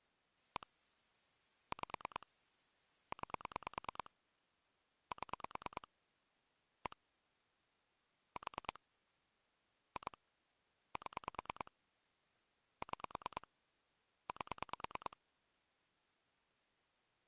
Pulse dialling, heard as clicks on a phone line, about 9 pulses a second. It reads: 1 5 9 7 1 4 2 7 6 8